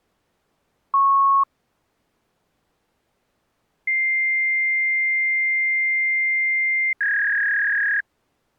Fax machine handshake, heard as a beep, a long tone and a warble.